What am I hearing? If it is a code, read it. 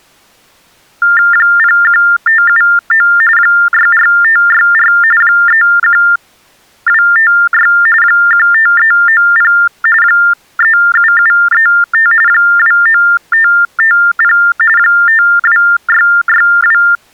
TTY/TDD text telephone tones (45.45 baud Baudot), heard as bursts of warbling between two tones, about 400 Hz shift, 1600 Hz centre. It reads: 01579 64564 31256 15390 37735 29550 52662